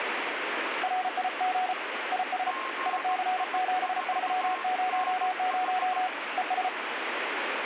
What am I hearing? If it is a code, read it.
Morse code, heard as two keyed tones, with radio static. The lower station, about 34 wpm, 740 Hz: RIG IS IC7300 ES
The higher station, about 17 wpm, 1060 Hz: GI4NH